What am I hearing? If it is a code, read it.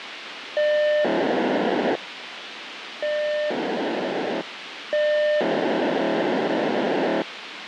POCSAG pager data (1200 baud), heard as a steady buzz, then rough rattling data, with radio hiss.